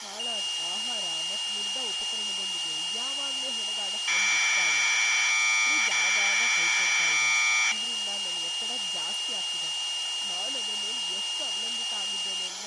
Commodore tape loading (standard loader), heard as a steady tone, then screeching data, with tape hiss and speech in Kannada.